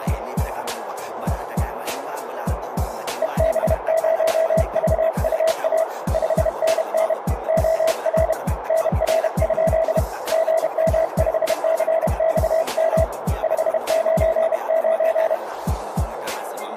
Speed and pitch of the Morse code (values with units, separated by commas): 31 wpm, 650 Hz